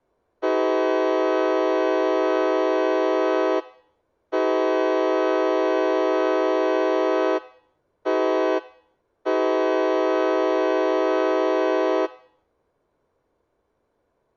Train horn signal, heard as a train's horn. 2 long, 1 short, 1 long. On North American railways: approaching a public crossing.